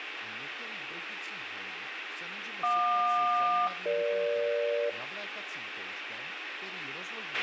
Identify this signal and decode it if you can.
Aircraft SELCAL, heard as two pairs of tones, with radio hiss, a squelch burst at the end and speech in Czech. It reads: JQ-EG